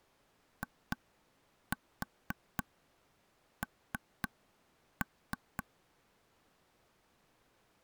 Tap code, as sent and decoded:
2-4 3-3
IN

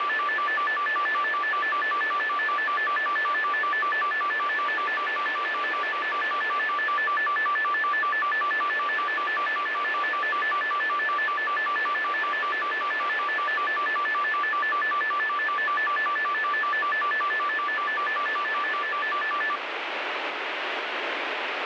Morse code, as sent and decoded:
none

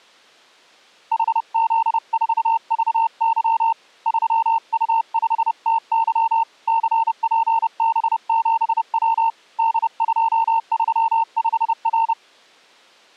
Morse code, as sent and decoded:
.... --.. ....- ...- -.-- / ...-- ..- ..... - -.-- / -.-. .--. -... --... .-- / -.. ..--- ...-- ..... .-.
HZ4VY 3U5TY CPB7W D235R

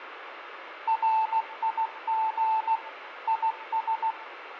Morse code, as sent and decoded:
.-. .. --. / .. ...
RIG IS

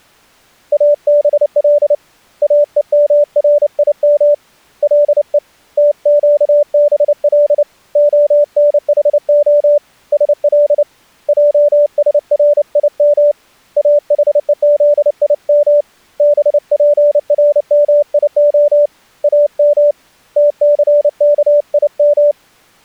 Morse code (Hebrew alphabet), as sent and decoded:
.- -... .-.. / .- . -- .-. .. -- / .-.. . / - --.- -... .-.. / --- -. .... --- / ... .-.. / .--- ... .-. .. -- / .- .... . --.. .. -- / -... .--. .-. -- .. --- / .- -- / - -.-. -.- .. --
אבל אומרים לו תקבל הנחה של עשרים אחוזים בפרמיה אם תסכים

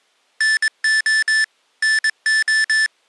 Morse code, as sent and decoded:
-. --- / -. ---
NO NO

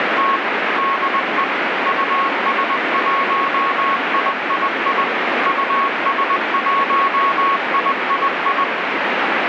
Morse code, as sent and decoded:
… / -.. . / ..- ... .---- .. .. .. / ..- ... .---- .. .. ..
… DE US1III US1III

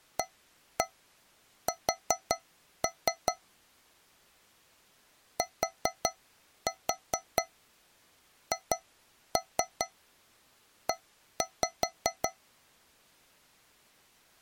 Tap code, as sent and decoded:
1-1 4-3 / 4-4 2-3 1-5
AS THE

